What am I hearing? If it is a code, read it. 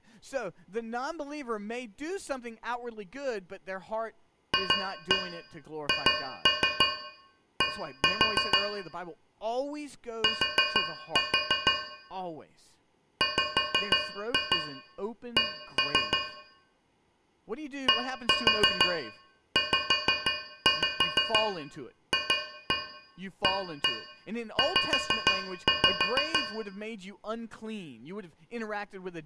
Tap code, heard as taps on a metal pipe, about 6 knocks a second, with room echo and speech in English. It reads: FHD T WC DZFAZ